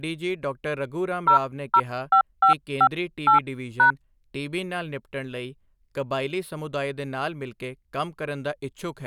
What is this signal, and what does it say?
DTMF, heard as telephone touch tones, dialled by hand, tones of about 90 ms, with speech in Punjabi. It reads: 005558#